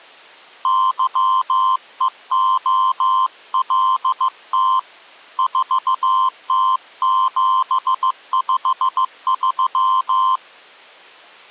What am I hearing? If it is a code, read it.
Morse code, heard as a keyed tone, hand-sent with a paddle, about 15 wpm, 1040 Hz. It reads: YEOLT 4T753